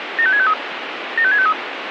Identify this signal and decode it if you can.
Five-tone selective call (ZVEI), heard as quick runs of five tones, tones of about 70 ms, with radio hiss. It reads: 75653 75653